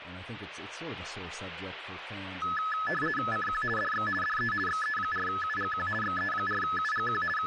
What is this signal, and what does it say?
RTTY (50 baud, 450 Hz shift), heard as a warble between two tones, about 1500 Hz centre, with radio static and speech in English. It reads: CQ DX DE XE4UGQ XE4UGQ …